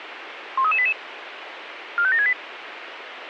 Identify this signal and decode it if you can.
Five-tone selective call (ZVEI), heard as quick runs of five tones, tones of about 70 ms, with radio hiss. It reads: 13388 45768